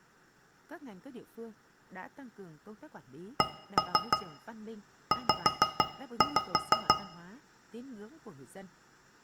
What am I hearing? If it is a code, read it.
Tap code, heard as taps on a metal pipe, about 5 knocks a second, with room echo and speech in Vietnamese. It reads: CZ